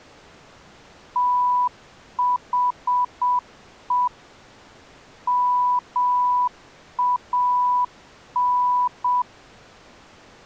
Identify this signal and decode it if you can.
Morse code, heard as a keyed tone, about 7 wpm, 990 Hz. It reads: THE MAN